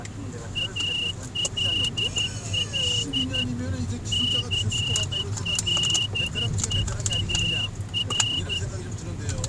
Morse code, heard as a whistle, hand-sent with a straight key, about 12 wpm, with the noise inside a car. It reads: ALL CLEAR